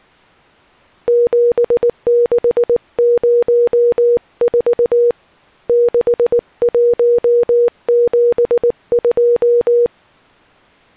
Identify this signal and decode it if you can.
Morse code, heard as a keyed tone, hand-sent with a paddle, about 19 wpm, 480 Hz. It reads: 7604 6172